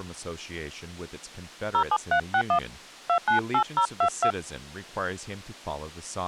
DTMF, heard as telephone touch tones, dialled by hand, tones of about 80 ms, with speech in English. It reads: 07361 298022